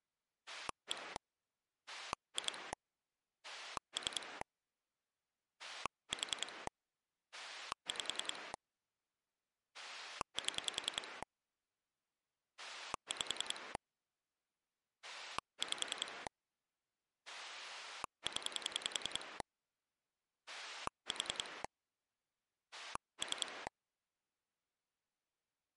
Pulse dialling, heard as a rotary dial, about 10 pulses a second. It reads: 1 2 3 4 5 7 5 5 0 4 3